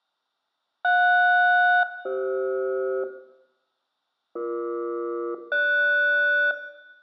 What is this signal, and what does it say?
Aircraft SELCAL, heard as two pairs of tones, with room echo. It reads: JS-CF BE-GS